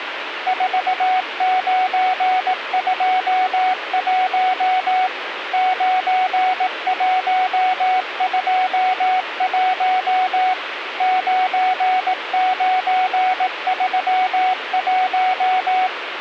Morse code, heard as a keyed tone, machine-sent, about 18 wpm, 740 Hz, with radio static. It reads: 4921 9121 9931